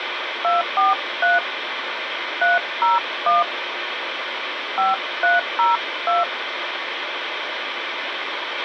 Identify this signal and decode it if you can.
DTMF, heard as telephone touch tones, dialled by hand, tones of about 160 ms, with radio hiss and a squelch burst at the end. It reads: 243 301 5302